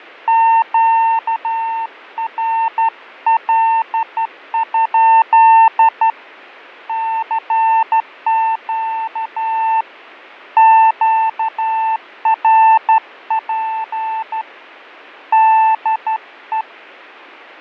Morse code, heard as a keyed tone, hand-sent with a straight key, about 12 wpm, 900 Hz, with fading. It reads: QRL? CQ QRP DE